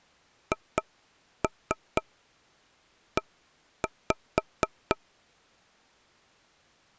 Tap code, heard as taps on a table, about 4 knocks a second. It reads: HE